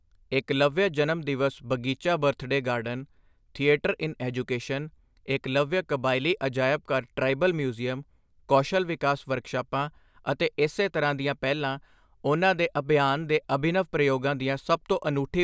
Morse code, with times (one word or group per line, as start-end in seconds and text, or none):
none